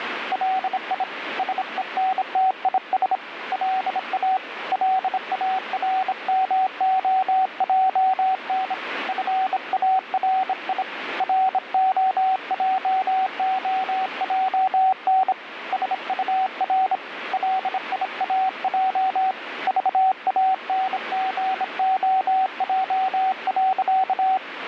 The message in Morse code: LI SENTIS LA LARMOJN FARI ROJOJN SUR LIAJ VANGOJ.

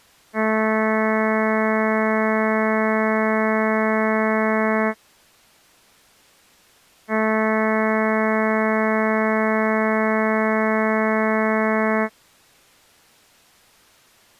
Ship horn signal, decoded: 2 long

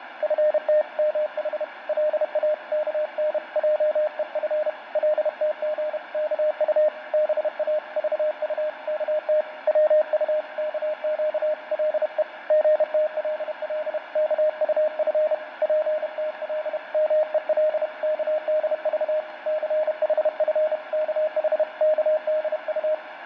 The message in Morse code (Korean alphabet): 너무 고요한 것이 도리어 비애가 섞인 적막을 춘우의

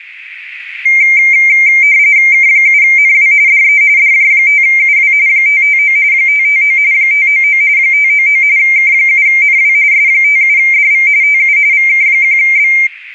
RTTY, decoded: K7NW DE DJ5UW 559 559 599 599 K7NW S57DV TU VK1B

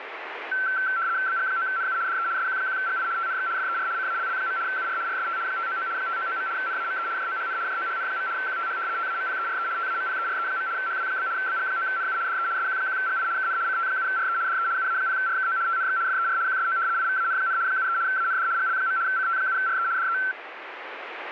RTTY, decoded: BG9NU DE SQ1GI TNX FER CALL. UR RST 599 599. NAME JOHN JOHN. QTH TAMPERE TAMPERE. HW? BG9NU DE SQ1GI KN CT7RE DE UA0RKO TNX FER QSO IVAN, 73 AND GL. CT7RE DE

